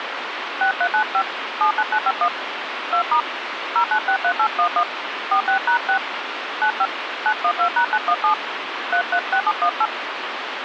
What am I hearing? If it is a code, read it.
DTMF, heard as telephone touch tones, dialled by hand, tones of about 70 ms, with radio hiss. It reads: 6395 79951 2* 0963811 46#6 95 912#917 336718